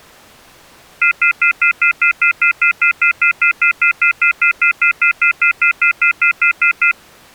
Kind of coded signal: telephone call progress tone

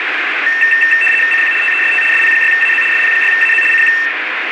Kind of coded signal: RTTY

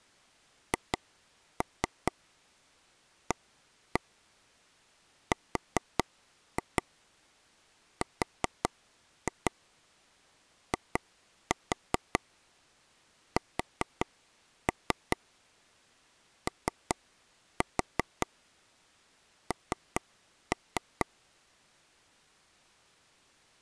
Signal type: tap code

